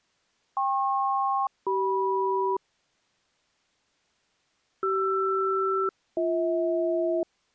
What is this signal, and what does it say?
Aircraft SELCAL, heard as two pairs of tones. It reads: KP-CM CR-BH